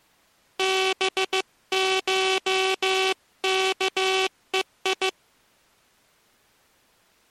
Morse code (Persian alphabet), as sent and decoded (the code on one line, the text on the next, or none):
-... ---- -.- . ..
بشکهی